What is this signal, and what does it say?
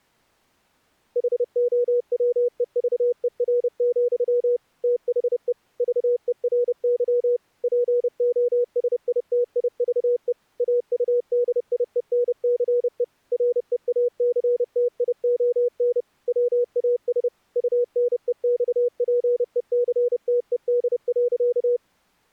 Morse code, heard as a keyed tone, machine-sent, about 30 wpm, 480 Hz. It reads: HOWEVER, THE VERY POSITIVE AUDIENCE REACTION WAS UNEXPECTED.